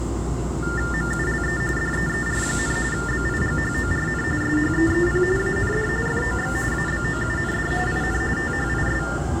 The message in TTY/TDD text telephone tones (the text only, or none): MULE DEER, BIGHORN SHEEP AND FOX ABOUND IN THIS